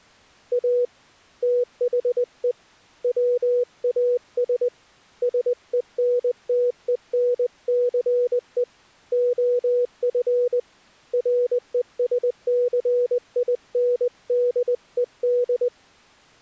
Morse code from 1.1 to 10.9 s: THE WAS SENTENCE OF

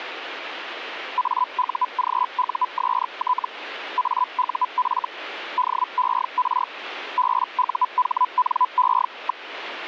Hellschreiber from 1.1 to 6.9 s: AUGUST AUF DER

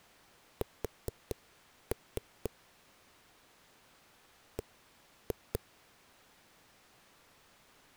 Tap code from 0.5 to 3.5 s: S

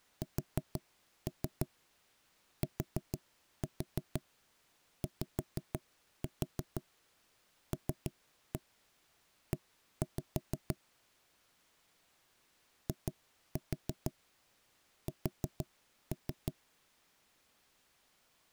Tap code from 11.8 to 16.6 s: IS

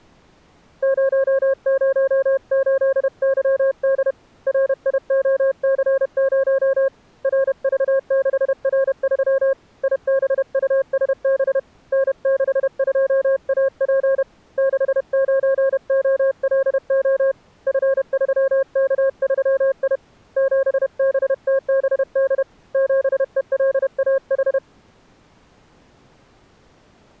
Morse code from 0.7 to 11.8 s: 008YD RIOC0 RV6R3 IBUSB

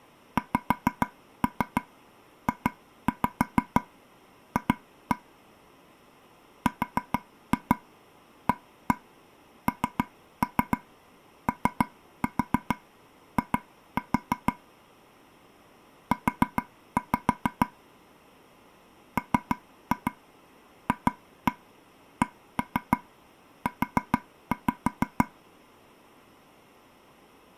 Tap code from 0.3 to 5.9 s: XJF

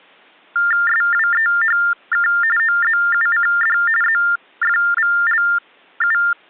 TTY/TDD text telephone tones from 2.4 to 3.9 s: OZUCD

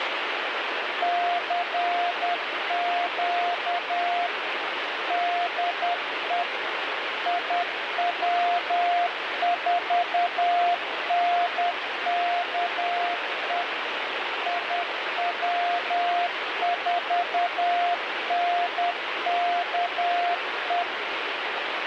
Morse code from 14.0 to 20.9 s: IW4NKE

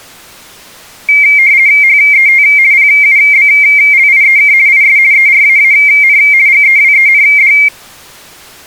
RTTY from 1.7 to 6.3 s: HET PUBLIEK IS ERAAN

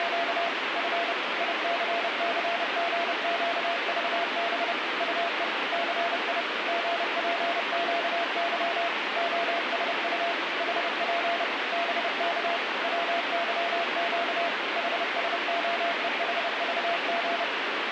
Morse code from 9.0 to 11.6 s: OSU HP

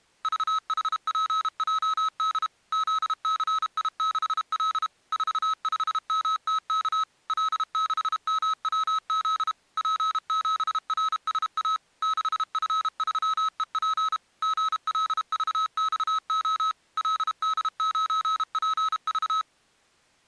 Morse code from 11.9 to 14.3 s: 6F3EP

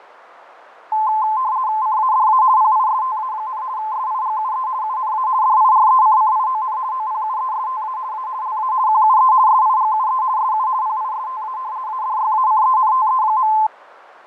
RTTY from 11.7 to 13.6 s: ADYACENTE.

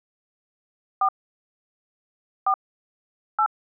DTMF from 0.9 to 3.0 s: 4 4

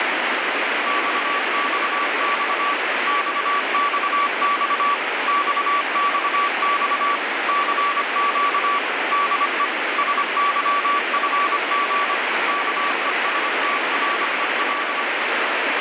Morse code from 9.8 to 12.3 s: SYFG

